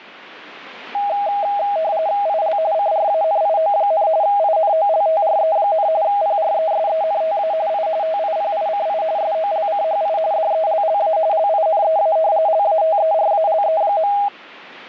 RTTY (45.45 baud, 170 Hz shift), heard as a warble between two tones, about 730 Hz centre, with static crashes. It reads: IL CRANIO, INOLTRE, PRESENTA I TIPICI SOLCHI DELLA LINEA LATERALE.